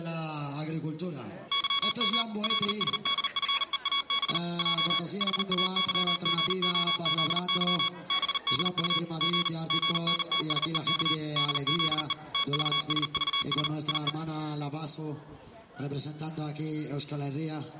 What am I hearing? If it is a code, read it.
Morse code, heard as electronic beeps, machine-sent, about 39 wpm, 1120 Hz. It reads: YM LSDFEAB J HAYGOZY BDU G GNTSEK DZE TVSVS IE